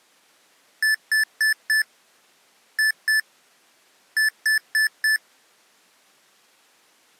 Beep code, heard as beeps from a small speaker, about 1750 Hz. 4-2-4. In Phoenix BIOS tables: unexpected interrupt in protected mode.